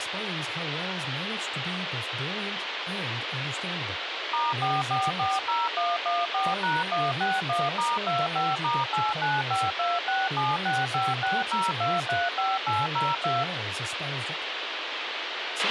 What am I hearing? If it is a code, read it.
DTMF, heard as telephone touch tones, dialled by machine, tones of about 200 ms, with radio hiss and a squelch burst at the end. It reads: *4440114#161*25*8952676560235802